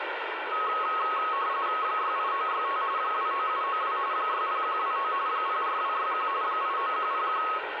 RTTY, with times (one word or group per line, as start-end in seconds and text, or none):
1.8-2.8 68965
3.0-4.0 29792
4.1-5.1 60129
5.3-6.3 04261
6.4-7.4 89101